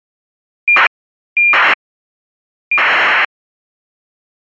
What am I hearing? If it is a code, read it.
ACARS aircraft data, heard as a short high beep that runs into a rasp, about 2400 baud.